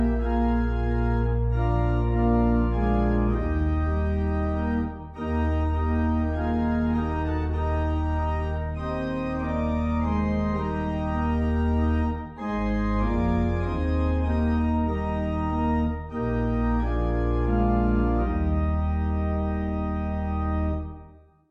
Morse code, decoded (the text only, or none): none